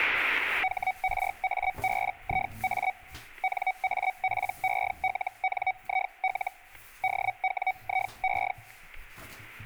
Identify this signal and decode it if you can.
Hellschreiber (Feld-Hell, 122.5 baud), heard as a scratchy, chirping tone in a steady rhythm, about 750 Hz, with the noise of a restroom. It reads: HRABIA NAPELNIL DWIE